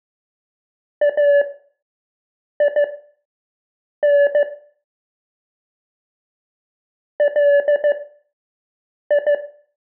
Morse code (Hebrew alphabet), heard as a keyed tone, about 15 wpm, spaced as for 6 wpm, 570 Hz, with room echo. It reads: אין לי